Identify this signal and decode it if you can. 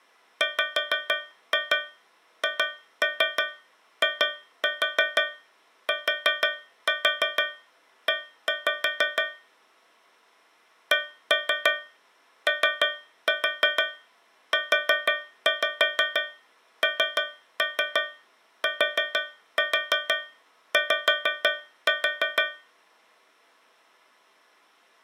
Tap code, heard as taps on a metal pipe, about 6 knocks a second. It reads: WHITE COUNTY